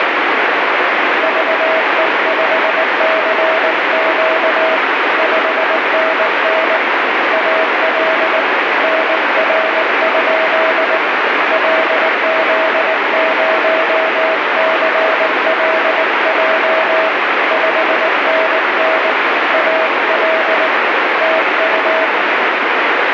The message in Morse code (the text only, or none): VE5CQ 5NN AL NR? LZ0CLJ 5NN AL TU